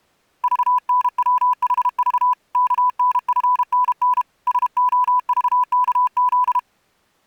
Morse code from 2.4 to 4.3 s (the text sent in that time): KNFNN